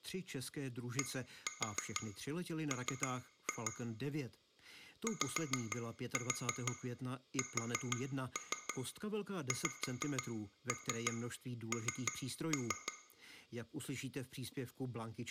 Tap code, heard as taps on glass, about 6 knocks a second, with room echo and speech in Czech. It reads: DM YSXN